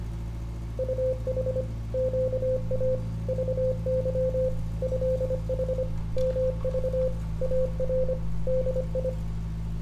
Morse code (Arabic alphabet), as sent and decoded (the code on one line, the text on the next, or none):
..- .... / --.- .- / ...- -.-- / ..-.. .... / -- ...- / .- .-. / -.. ..
طح قا ضظ هح مض ار دي